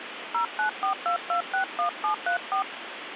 DTMF, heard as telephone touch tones, dialled by hand, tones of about 100 ms, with phone line noise. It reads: 0942261734